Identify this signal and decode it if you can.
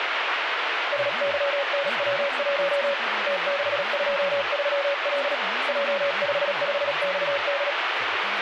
Morse code, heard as a keyed tone, hand-sent with a paddle, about 37 wpm, 560 Hz, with radio static and speech in Telugu. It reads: SYNW1 T623L J55XD